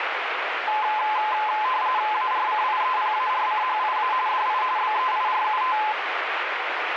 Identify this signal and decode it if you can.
RTTY (45.45 baud, 170 Hz shift), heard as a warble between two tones, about 940 Hz centre, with radio static. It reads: ARCIEPARCHIA DI BEIRUT